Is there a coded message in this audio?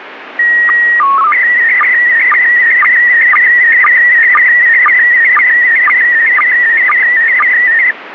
Yes: SSTV (slow-scan television), PD 120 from 0.4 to 7.9 s, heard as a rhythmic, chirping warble, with radio static.